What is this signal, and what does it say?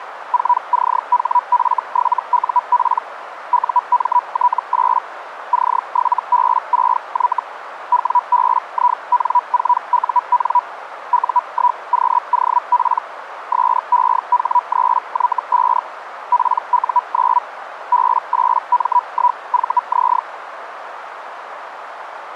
Hellschreiber (Feld-Hell, 122.5 baud), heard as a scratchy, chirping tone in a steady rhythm, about 980 Hz, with radio static and a narrow filter. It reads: 4CHF7UP UMT8 C7B6Y WBIN4UN U1QOP SEH3Y5 PU9 B8M1VZ